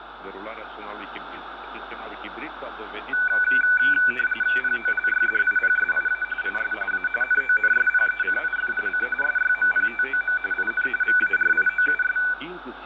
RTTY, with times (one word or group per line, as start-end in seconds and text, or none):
4.6-6.2 POLYDIPSIA
6.4-6.7 IS
6.9-7.1 A
7.2-9.1 NONSPECIFIC
9.2-10.4 SYMPTOM
10.5-10.9 IN
11.0-12.2 VARIOUS